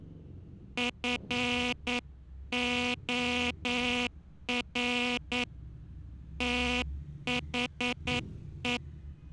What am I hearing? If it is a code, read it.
Morse code, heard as a buzzer, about 9 wpm, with street noise. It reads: FOR THE